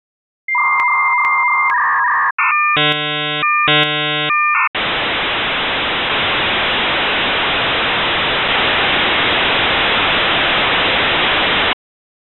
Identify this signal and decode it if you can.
Dial-up modem handshake (V.34 or later), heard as a whistle, warbles, then hiss.